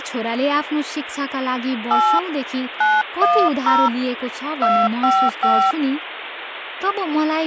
DTMF, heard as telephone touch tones, dialled by hand, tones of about 270 ms, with phone line noise and speech in Nepali. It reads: 8 910 255